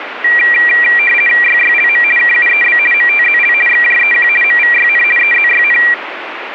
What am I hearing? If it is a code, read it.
RTTY (50 baud, 450 Hz shift), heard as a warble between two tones, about 2150 Hz centre, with radio static. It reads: YYLM KUEB MTZL XJEQ MVYN EZYN